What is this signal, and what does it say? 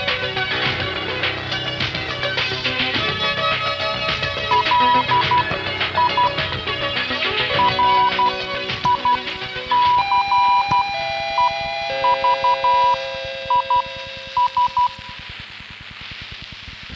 Morse code, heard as a keyed tone, machine-sent, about 12 wpm, spaced as for 9 wpm, 980 Hz. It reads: LI RICEVIS